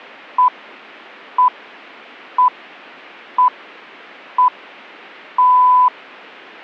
Radio time signal (six pips, as the Greenwich Time Signal), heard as pips.